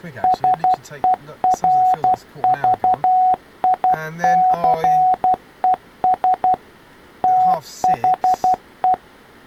Morse code, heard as a keyed tone, machine-sent, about 12 wpm, 740 Hz, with speech in English. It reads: SERVICES THE